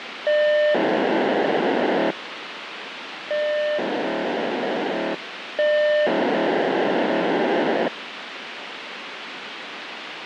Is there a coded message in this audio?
Yes: POCSAG pager data (1200 baud) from 0.3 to 7.9 s, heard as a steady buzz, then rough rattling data, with radio hiss.